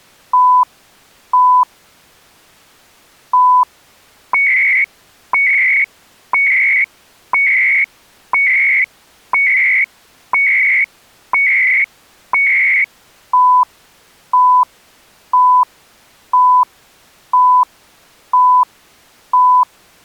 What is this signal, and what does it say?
Radio time signal (CHU, Canada), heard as beeps and data bursts, one a second.